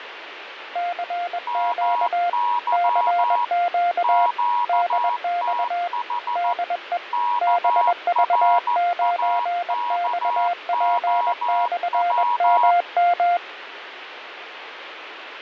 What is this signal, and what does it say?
Morse code, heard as two keyed tones, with radio static and fading. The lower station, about 21 wpm, 700 Hz: CQ CQ DX DE BV9XP/MM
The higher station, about 14 wpm, 960 Hz: MY QTH KRAKOW